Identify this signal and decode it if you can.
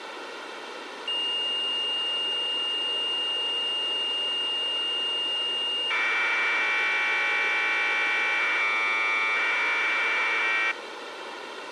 Commodore tape loading (standard loader), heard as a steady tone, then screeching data, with tape hiss.